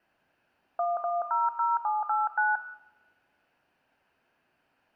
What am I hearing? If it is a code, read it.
DTMF, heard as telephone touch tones, dialled by hand, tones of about 180 ms, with room echo. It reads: 1100789